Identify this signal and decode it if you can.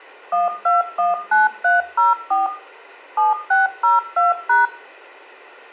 DTMF, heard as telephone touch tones, dialled by machine, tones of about 160 ms, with room echo. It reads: 1219304 7602#